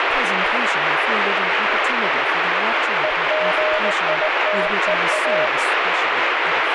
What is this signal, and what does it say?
Morse code, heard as a keyed tone, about 19 wpm, 620 Hz, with heavy radio static and speech in English. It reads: EGITEA